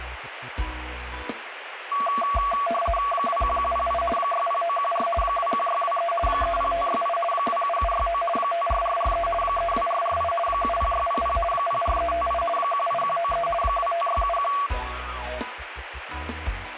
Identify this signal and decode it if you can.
RTTY (50 baud, 450 Hz shift), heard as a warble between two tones, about 910 Hz centre, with radio static. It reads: 21108 60914 21623 30568 27769 54443 32448 70600 04358 18193 25671